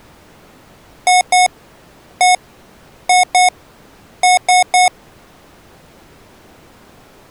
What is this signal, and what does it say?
Beep code, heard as beeps from a small speaker, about 730 Hz. 2-1-2-3. In Phoenix BIOS tables: ROM copyright notice check failure.